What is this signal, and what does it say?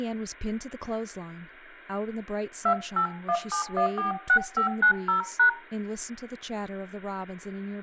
DTMF, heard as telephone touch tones, dialled by hand, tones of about 100 ms, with speech in English. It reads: 2817146590#